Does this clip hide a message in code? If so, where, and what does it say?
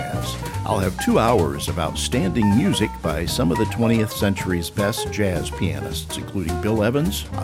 No.